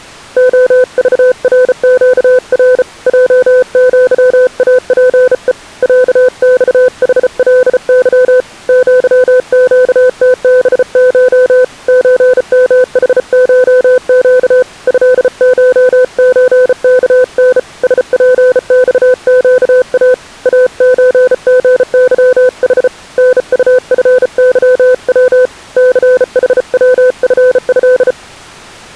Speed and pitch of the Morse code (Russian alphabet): 34 wpm, 510 Hz

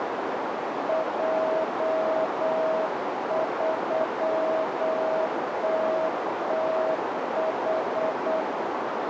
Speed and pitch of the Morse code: 8 wpm, 640 Hz

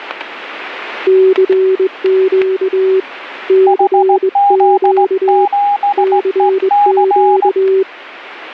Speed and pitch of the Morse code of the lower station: 21 wpm, 380 Hz

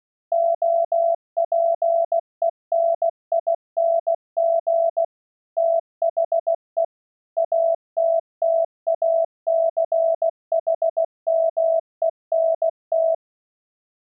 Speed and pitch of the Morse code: 16 wpm, 660 Hz

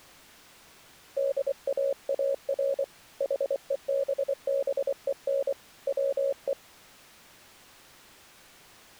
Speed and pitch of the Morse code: 24 wpm, 550 Hz

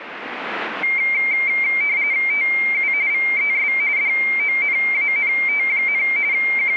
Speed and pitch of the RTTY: 45.45 baud, 170 Hz shift, 2200 Hz centre

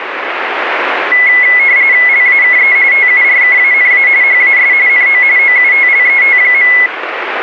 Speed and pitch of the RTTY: 45.45 baud, 170 Hz shift, 2100 Hz centre

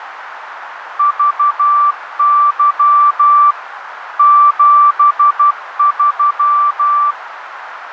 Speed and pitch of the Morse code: 12 wpm, 1170 Hz

